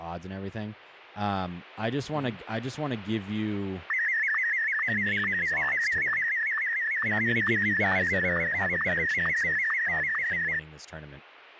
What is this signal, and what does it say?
SSTV (slow-scan television), Martin M1, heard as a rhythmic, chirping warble, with speech in English.